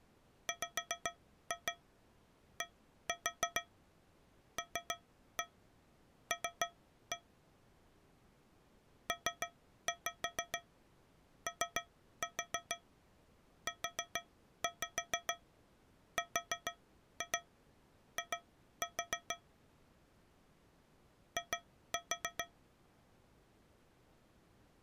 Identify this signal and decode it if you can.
Tap code, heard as taps on a metal pipe, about 6 knocks a second. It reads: WDLL POURI I